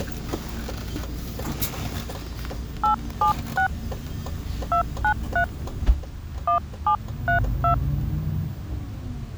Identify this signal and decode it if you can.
DTMF, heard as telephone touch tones, dialled by hand, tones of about 100 ms, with the noise inside a bus. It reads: 876 293 1732